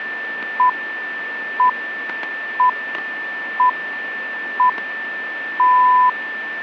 Radio time signal (six pips, as the Greenwich Time Signal), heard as pips, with static crashes and a steady whistle near 1780 Hz.